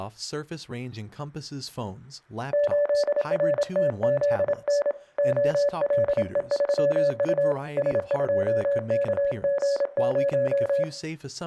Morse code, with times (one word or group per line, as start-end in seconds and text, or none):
2.5-4.9 8RTZN
5.2-7.5 OLE3U
7.8-10.8 S2KG0